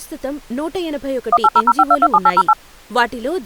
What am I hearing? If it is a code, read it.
DTMF, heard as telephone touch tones, dialled by machine, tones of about 50 ms, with speech in Telugu. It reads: 18005227808